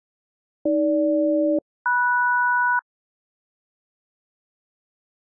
Aircraft SELCAL, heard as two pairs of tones. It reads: AG-MS